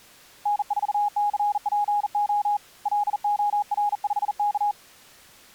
Morse code, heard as a keyed tone, hand-sent with a bug key, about 40 wpm, 830 Hz. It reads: N4CPO LOR5K